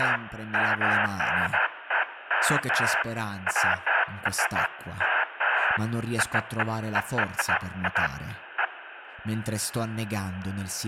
Bursts of noise, with phone line noise and speech in Italian. There is no code.